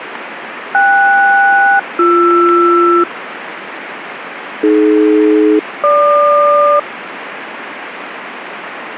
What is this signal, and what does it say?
Aircraft SELCAL, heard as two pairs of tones, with radio static. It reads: KS-BR AD-GQ